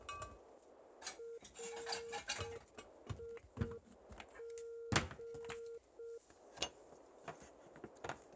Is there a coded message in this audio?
Yes: Morse code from 1.1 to 6.2 s, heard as a keyed tone, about 6 wpm, 460 Hz, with kitchen noise. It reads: RIG